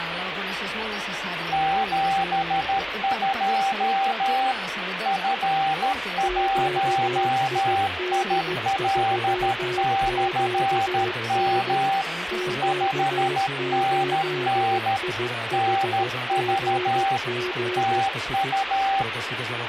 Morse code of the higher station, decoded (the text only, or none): 72 F1IL/M 5NN NV TU